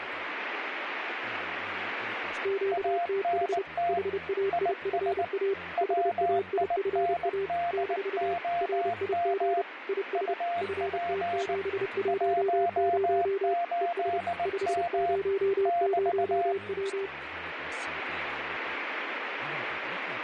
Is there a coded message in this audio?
Yes: Morse code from 2.4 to 17.1 s, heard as two keyed tones, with radio static and speech in Finnish. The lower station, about 30 wpm, 390 Hz: QTH HAIFA HAIFA - RIG IS FT710 ES 500W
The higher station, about 19 wpm, 690 Hz: ANT IS WINDOM UP 18M <BT>